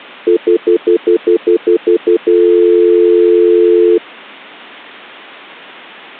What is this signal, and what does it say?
Telephone call progress tone (North American plan), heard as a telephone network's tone, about 350, 440 Hz, 0.1 s on and 0.1 s off. Stutter dial tone.